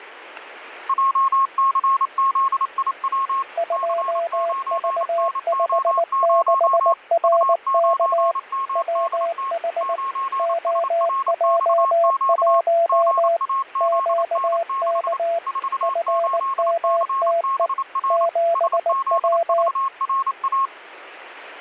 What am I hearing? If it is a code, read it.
Morse code, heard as two keyed tones, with radio static. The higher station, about 28 wpm, 1080 Hz: JCZIW C9NO0 U9MDT 9SRXQ GAZN6 48CBR SZVRA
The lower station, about 19 wpm, 680 Hz: 2V56RK WH OJ1 QK FMTE 7W